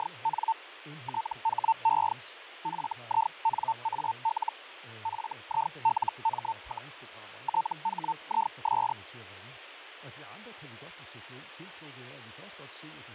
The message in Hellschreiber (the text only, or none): … THE FINAL FILM, THIS